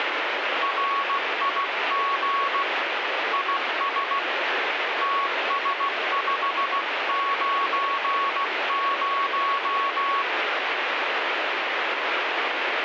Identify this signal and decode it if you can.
Morse code, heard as a keyed tone, hand-sent with a paddle, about 16 wpm, 1110 Hz, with radio static. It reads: RIG IS TS590